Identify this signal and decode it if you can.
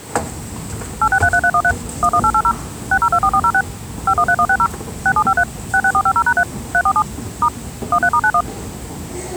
DTMF, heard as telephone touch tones, dialled by machine, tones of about 60 ms, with the noise of a subway station. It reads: 8633313 11880 6024406 513160 6753 66450#3 347 * 13*91